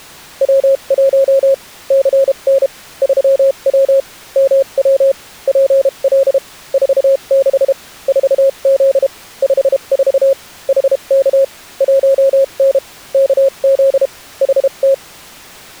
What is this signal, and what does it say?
Morse code, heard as a keyed tone, machine-sent, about 32 wpm, spaced as for 28 wpm, 540 Hz. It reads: W1 CN 3W MW PL 46 4Z 54 HK 1N KZ HT